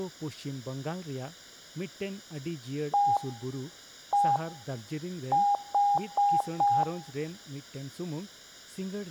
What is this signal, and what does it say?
Beep code, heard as beeps, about 810 Hz, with room echo and speech in Santali. 1-1-4. In Phoenix BIOS tables: BIOS ROM checksum failure.